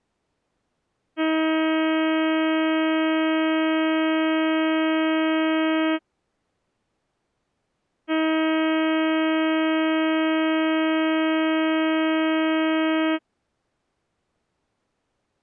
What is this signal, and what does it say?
Ship horn signal, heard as a ship's horn, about 320 Hz. 2 long. At sea: a vessel under power that has stopped in fog.